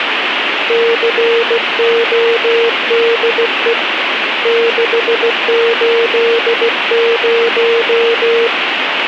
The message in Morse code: CODE 680

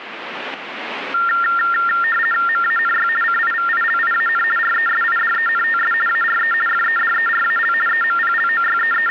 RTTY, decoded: MANY CIVILIAN RESIDENTS ARE FEDERAL …

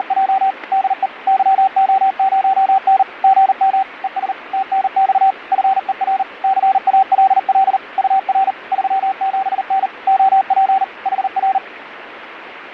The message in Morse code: … DE YO0N GM ES TNX FER CALL UR 37N OP HR

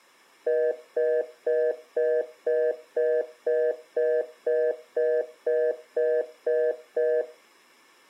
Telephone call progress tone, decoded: congestion tone

